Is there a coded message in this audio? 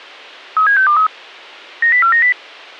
Yes: five-tone selective call (CCIR) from 0.6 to 2.3 s, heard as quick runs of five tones, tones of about 100 ms. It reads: 37623 90490